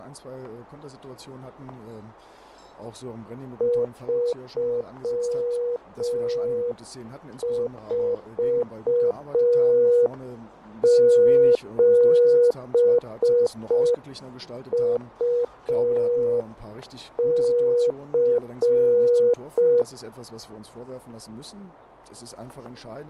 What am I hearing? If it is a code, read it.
Morse code, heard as a keyed tone, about 5 wpm, 480 Hz, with fading and static crashes. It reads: 347UC